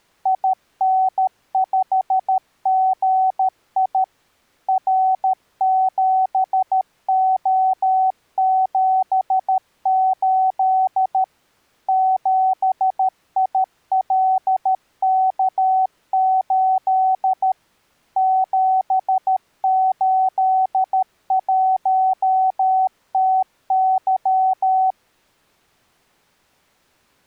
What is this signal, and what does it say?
Morse code, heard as a keyed tone, machine-sent, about 13 wpm, 760 Hz. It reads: IN5GI R7O78 7ILK8 781TY